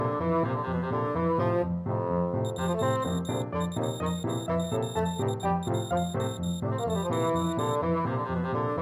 Morse code, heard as a high beeper, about 21 wpm, 3700 Hz. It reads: 12811